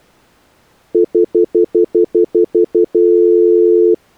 Telephone call progress tone (North American plan), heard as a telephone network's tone, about 350, 440 Hz, 0.1 s on and 0.1 s off. Stutter dial tone.